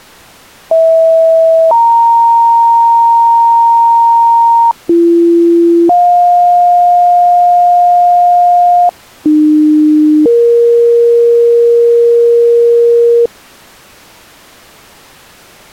Two-tone page, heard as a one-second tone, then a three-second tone, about 650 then 930 Hz, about 340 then 710 Hz, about 300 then 470 Hz.